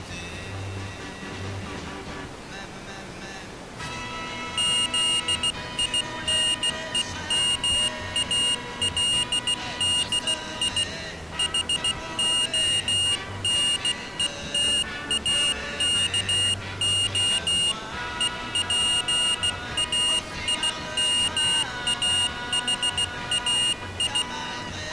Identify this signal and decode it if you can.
Morse code, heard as a high beeper, hand-sent with a bug key, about 16 wpm, 2850 Hz. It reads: ZINEMALDI HONETAKO EPAIMAHAI